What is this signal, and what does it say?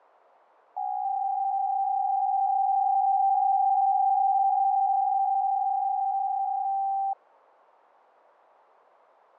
PSK63 (62.5 baud), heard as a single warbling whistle, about 780 Hz.